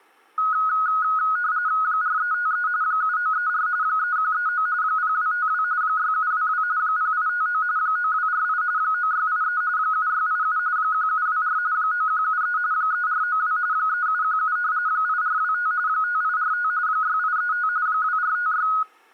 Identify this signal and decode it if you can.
RTTY (45.45 baud, 170 Hz shift), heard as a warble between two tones, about 1360 Hz centre. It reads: 4353 7934 3139 0252 6722 0859 9248 9683 7687 1724 9173 3492 3717 8425 5845 6835 2456